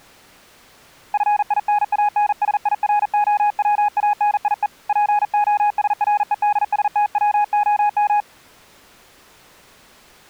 Morse code (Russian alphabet), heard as a keyed tone, hand-sent with a paddle, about 40 wpm, 830 Hz. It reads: ФИНАНСИРОВАНИЕ ПОСРЕДСТВОМ